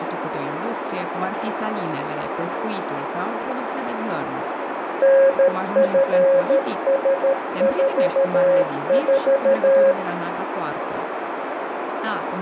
Morse code, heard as a keyed tone, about 13 wpm, 540 Hz, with radio static, a narrow filter and speech in Romanian. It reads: NFS44